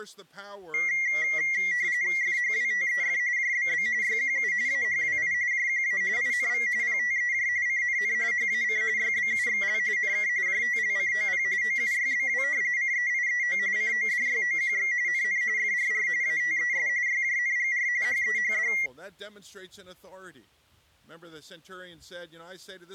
RTTY (45.45 baud, 170 Hz shift), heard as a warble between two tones, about 2050 Hz centre. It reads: FHWTEF JBB YQU AHWI JQA INV PTEJ CNN HAC YBUXL NK JTLCOP OUYBW CEIEO CODYOQX NN FRR ATES YJNGR HEHD